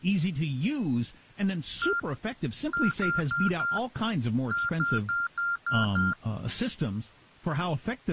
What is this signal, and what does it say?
Beep code, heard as beeps from a small speaker, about 1390 Hz, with speech in English. 1-4-6.